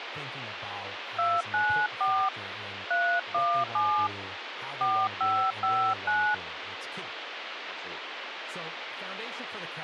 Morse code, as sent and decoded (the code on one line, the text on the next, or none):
none